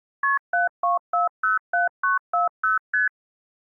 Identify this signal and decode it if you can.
Multi-frequency trunk signalling (R1, as on North American trunks), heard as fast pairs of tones, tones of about 140 ms. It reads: KP 72407940 ST